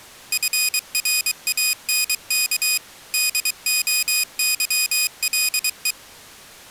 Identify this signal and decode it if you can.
Morse code, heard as a high beeper, machine-sent, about 23 wpm, 2500 Hz. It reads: FRANK DOYLE